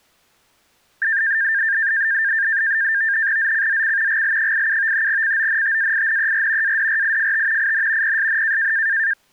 NAVTEX (SITOR-B), 100 baud, 170 Hz shift, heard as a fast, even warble, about 1700 Hz centre. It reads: ZCZC GL87 CONTAINER ADRIFT IN PSN